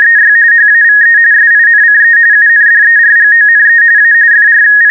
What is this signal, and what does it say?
RTTY (45.45 baud, 170 Hz shift), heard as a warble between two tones, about 1750 Hz centre. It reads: … HAVE SINCE UNDERGONE A …